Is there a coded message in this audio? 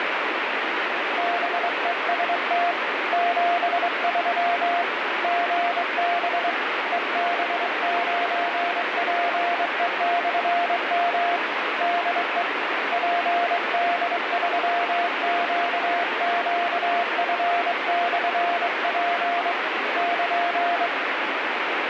Yes: Morse code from 1.1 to 20.9 s, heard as a keyed tone, hand-sent with a straight key, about 23 wpm, 700 Hz, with heavy radio static. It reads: BEST 73 GB EB9PE/M DE PD3QQF/P <KN>